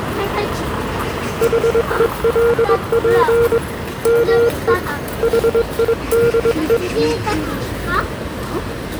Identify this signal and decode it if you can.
Morse code, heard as a keyed tone, hand-sent with a straight key, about 21 wpm, 470 Hz, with the noise of a residential street. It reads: HELP ME HIDE